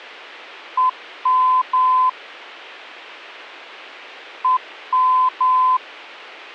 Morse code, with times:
0.8-2.1 EM
4.4-5.8 EM

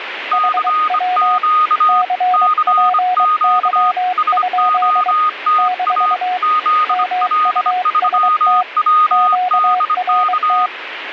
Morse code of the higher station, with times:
0.3-2.0 CQ
2.3-3.9 CQ
4.2-6.1 SOTA
6.4-10.7 ZL3WDK

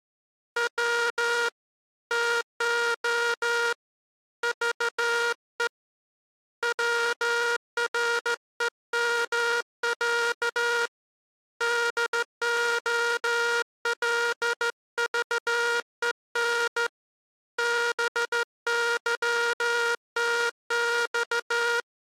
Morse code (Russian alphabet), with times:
0.6-1.5 В
2.1-3.7 ТО
4.4-5.7 ЖЕ
6.6-10.9 ВРЕМЯ
11.6-16.9 ДОЛЖЕН
17.6-21.8 БЫТЬ

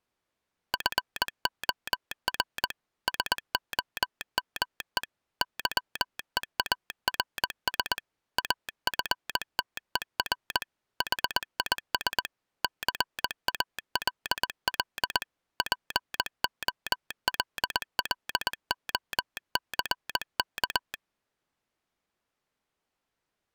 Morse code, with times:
0.7-2.7 FOR
3.1-5.0 SOME
5.4-8.0 YEARS
8.4-10.6 AFTER
11.0-12.3 HIS
12.6-15.2 CALL
15.6-20.9 POLLOCK

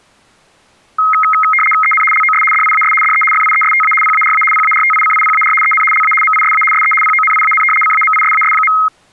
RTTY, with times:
1.8-2.0 EN
2.1-2.4 LOS
2.5-2.9 DIAS
3.0-3.2 DE
3.3-3.9 FIESTA
4.0-4.4 PARA
4.5-5.5 PARTICIPAR
5.6-5.8 EN
5.9-6.1 LA
6.2-6.6 MISA
6.7-6.9 SE
7.0-7.6 PONIAN
7.8-8.7 CAMISAS.

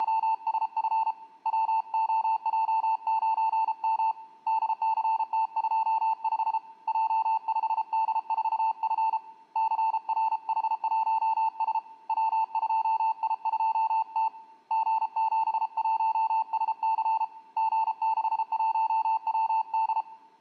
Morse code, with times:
0.0-1.1 …
1.5-4.1 WOJ9M
4.5-6.6 DCT25
6.9-9.2 J5D4F
9.6-11.8 CRH1S
12.1-14.3 W2I2T
14.7-17.2 G71SC
17.6-20.0 G61WD

